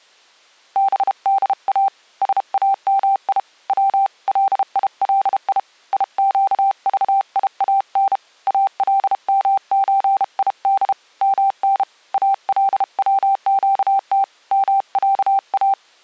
Morse code (Arabic alphabet), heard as a keyed tone, hand-sent with a paddle, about 32 wpm, 780 Hz. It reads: بدا سامي و ليلي يقضيان المزيد من الوقت معا